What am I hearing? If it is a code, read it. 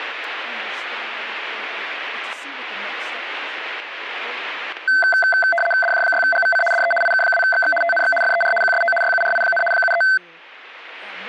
RTTY (75 baud, 850 Hz shift), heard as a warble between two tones, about 1110 Hz centre, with speech in English. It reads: DJ6GVC DE IK2XX TNX FER QSO YURI, 73